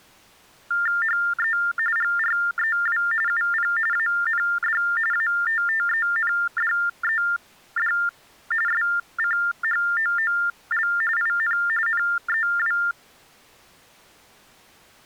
TTY/TDD text telephone tones (45.45 baud Baudot), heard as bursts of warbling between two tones, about 400 Hz shift, 1600 Hz centre. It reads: HE GREW UP AND ATTENDED SCHOOL IN NEW